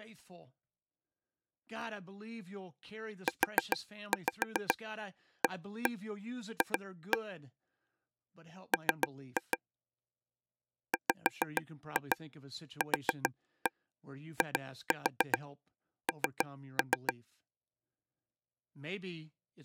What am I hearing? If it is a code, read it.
Tap code, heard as taps on a table, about 7 knocks a second, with speech in English. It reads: UAF M WQIN